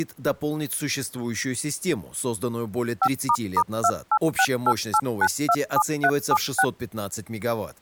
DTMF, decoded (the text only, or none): 5**28688927376